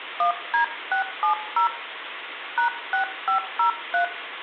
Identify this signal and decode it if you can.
DTMF, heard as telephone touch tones, dialled by hand, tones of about 110 ms, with phone line noise and room echo. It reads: 1D670 #6503